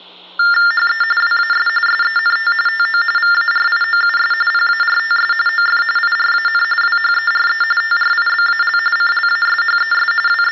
TTY/TDD text telephone tones (45.45 baud Baudot), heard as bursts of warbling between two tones, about 400 Hz shift, 1600 Hz centre, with hum. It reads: HE WAS SENT TO VARIOUS PARTS OF IRAN WHERE TRIBAL CLASHES …